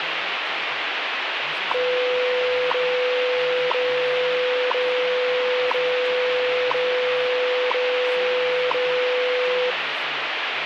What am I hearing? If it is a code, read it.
Radio time signal (WWV, Colorado), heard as ticks, one a second, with radio static and speech in Nepali.